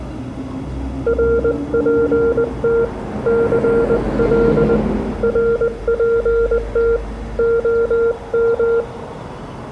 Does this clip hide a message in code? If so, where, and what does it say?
Yes: Morse code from 1.0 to 8.9 s, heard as a keyed tone, hand-sent with a paddle, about 20 wpm, 460 Hz, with room echo and street noise. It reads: RPT CL RPT OM